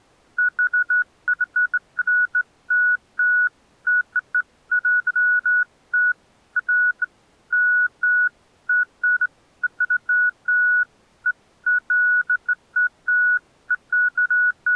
Beeps of irregular length. There is no code.